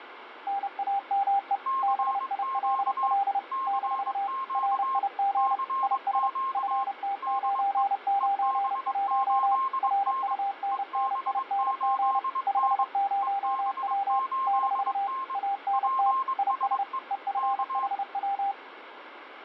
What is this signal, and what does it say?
Morse code, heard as two keyed tones, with radio static. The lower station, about 30 wpm, 800 Hz: NAME BILL - RIG IS FT991 RUNNING 50W - ANT IS EFHW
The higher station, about 22 wpm, 1060 Hz: CQ CQ CQ DE EB8N EB8N EB8N PSE K